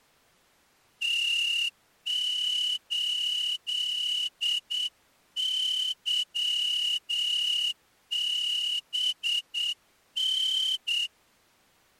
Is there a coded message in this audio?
Yes: Morse code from 1.0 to 11.1 s, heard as a whistle, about 8 wpm. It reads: T8YBN